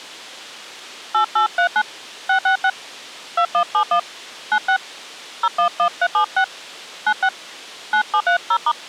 DTMF, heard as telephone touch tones, dialled by hand, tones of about 80 ms. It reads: 8839 666 2171 96 011376 96 9730*